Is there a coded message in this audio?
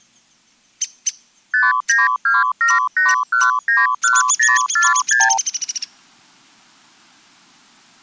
Yes: multi-frequency trunk signalling (R2, with the far end's replies) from 1.5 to 5.4 s, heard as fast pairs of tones, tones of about 180 ms. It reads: 59278191046